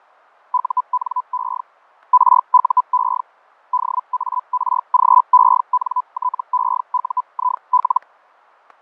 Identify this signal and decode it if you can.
Hellschreiber (Feld-Hell, 122.5 baud), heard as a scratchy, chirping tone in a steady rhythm, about 1000 Hz, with fading and static crashes. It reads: UNE RUE DARGENTEUIL